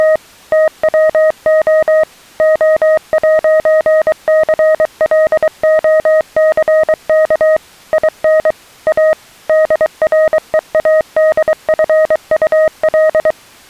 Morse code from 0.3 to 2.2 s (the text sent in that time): TWO